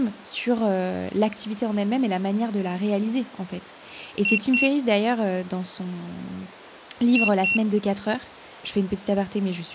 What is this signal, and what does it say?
Beep code, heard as a piezo beeper, played twice, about 2750 Hz, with speech in French. 2 short. In AMI BIOS tables: memory parity error; in IBM BIOS tables: self-test error shown on screen; in Dell tables: no memory detected.